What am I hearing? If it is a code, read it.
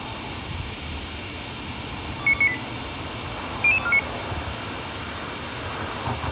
Five-tone selective call (ZVEI), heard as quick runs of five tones, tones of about 70 ms, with radio hiss and street noise. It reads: 29298 00249